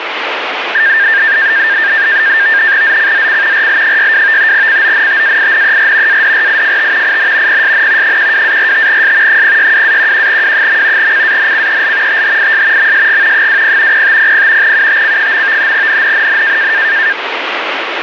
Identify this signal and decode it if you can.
NAVTEX (SITOR-B), 100 baud, 170 Hz shift, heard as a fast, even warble, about 1700 Hz centre, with radio static. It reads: ZCZC RL62 CONTAINER ADRIFT IN PSN 12-45S 062-11W. CANCEL THIS MSG 20 0500 UTC. NNNN